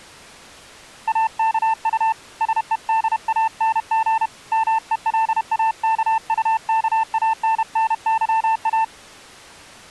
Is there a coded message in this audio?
Yes: Morse code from 1.0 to 8.9 s, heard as a keyed tone, hand-sent with a paddle, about 31 wpm, 890 Hz. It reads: AKU SEDANG MELAKUKANNYA